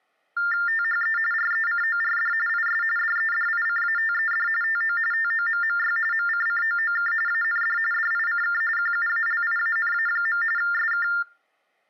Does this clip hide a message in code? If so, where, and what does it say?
Yes: TTY/TDD text telephone tones (45.45 baud Baudot) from 0.4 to 11.2 s, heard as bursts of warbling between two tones, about 400 Hz shift, 1600 Hz centre. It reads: THE RECORD IS DEDICATED TO TOMMY MCCOOK AND DICK QUALIANA. SK